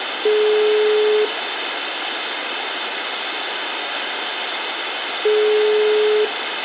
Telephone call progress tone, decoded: ringback tone

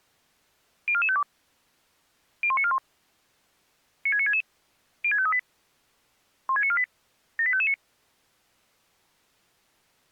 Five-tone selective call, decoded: 04452 01941 96966 06538 16948 78559

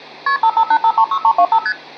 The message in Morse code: none

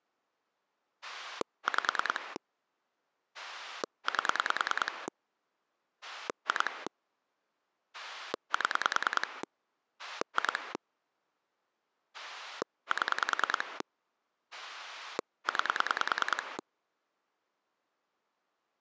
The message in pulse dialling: 5 8 2 7 2 7 9

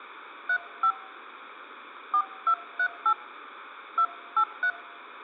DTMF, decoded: 35 4238 283

